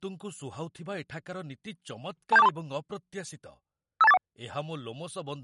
Five-tone selective call (EIA), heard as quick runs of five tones, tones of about 30 ms, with speech in Odia. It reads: 27423 52841